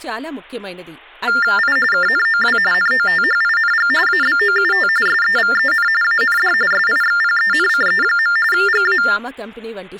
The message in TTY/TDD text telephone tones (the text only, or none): I KNOW NOTHING ABOUT SEVEN AND SIXPENCE. GA